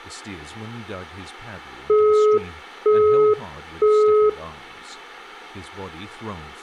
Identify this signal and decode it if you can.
Telephone call progress tone (single-tone plan, as in Europe, Japan and elsewhere), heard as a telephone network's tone, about 420 Hz, 0.48 s on and 0.48 s off, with speech in English. Busy tone.